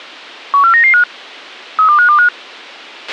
Five-tone selective call (CCIR), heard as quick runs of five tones, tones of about 100 ms, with a squelch burst at the end. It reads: 14995 32525